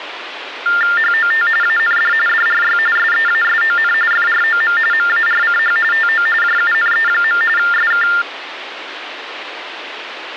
TTY/TDD text telephone tones (45.45 baud Baudot), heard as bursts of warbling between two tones, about 400 Hz shift, 1600 Hz centre, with phone line noise. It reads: HOT AND DRY SEASON FROM MARCH TO JUNE. SK